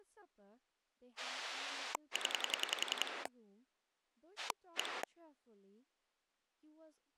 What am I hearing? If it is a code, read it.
Pulse dialling, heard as a rotary dial, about 10 pulses a second, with speech in English. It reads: 0 1